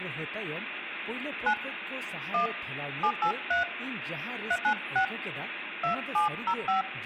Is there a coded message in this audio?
Yes: DTMF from 1.5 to 6.8 s, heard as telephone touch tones, dialled by hand, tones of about 90 ms, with phone line noise, room echo and speech in Santali. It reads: 9 1 783 396 2705